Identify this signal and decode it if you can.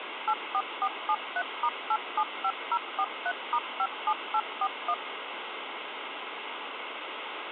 DTMF, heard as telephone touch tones, dialled by machine, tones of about 60 ms, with phone line noise. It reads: 84473*875043*57841